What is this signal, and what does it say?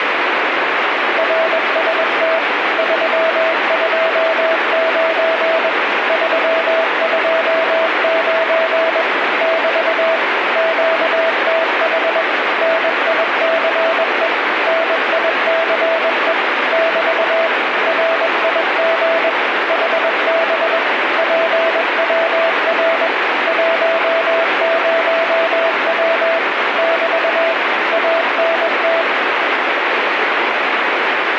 Morse code, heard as a keyed tone, machine-sent, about 21 wpm, 660 Hz, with heavy radio static. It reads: RST 329 329 <BT> QTH NICE NICE <BT> RIG HB PWR 10W <BT> ANT